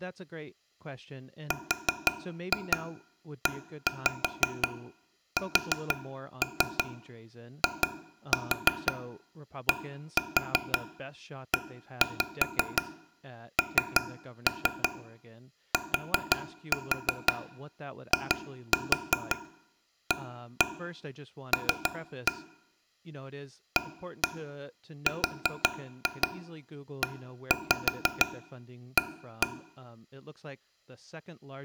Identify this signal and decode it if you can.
Tap code, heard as taps on a table, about 5 knocks a second, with speech in English. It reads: RESIDENTIAL AREA